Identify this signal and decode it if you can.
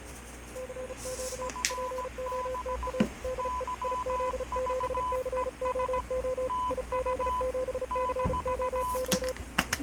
Morse code, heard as two keyed tones, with radio static, fading and kitchen noise. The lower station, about 35 wpm, 510 Hz: CQ POTA DE IZ7COO IZ7COO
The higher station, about 17 wpm, 1000 Hz: FB YVES TU -